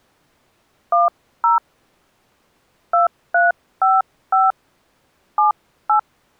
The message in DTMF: 10 2355 78

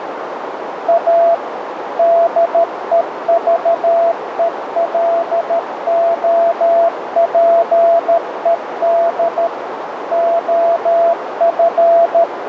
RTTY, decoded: none

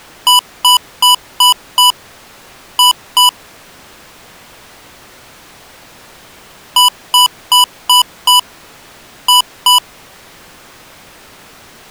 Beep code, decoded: 5-2

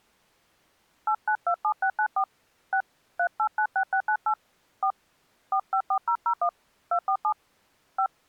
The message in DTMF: 8927694 6 3896698 4 454001 247 5

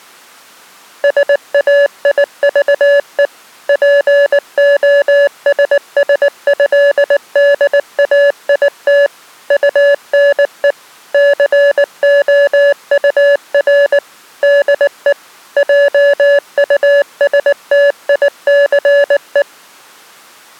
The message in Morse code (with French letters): SAIVE POSSÉDAIT UNE COUR DE JUSTICE

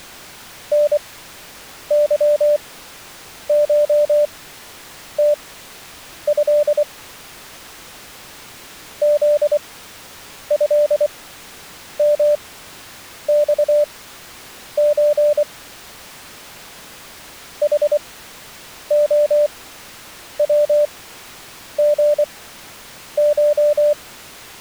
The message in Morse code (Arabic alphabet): نظشته ذهمصز حخوغش

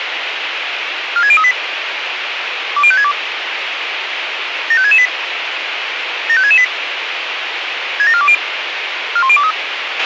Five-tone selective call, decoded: 46038 20562 75668 75668 67420 41023

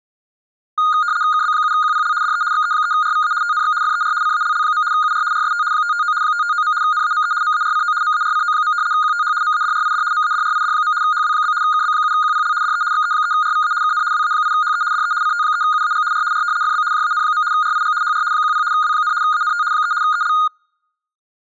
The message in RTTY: KB7QPL DE XE3RVA TNX FER CALL. UR RST 559 559. NAME MARCO MARCO. QTH MADRID MADRID. HW? KB7QPL DE XE3RVA KN WA8HE DE CT3UAG R R FB JAN. RIG HR 10 W, ANT 3 EL

